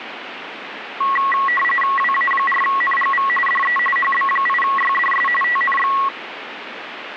RTTY (45.45 baud, 850 Hz shift), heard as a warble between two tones, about 1500 Hz centre, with radio static. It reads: WA4NGV DE HB8YDS TNX